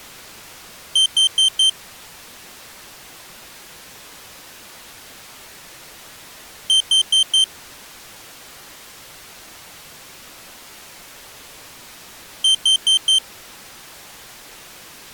Alarm pattern, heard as an alarm's beeps, played three times, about 3100 Hz. Temporal four. Carbon monoxide.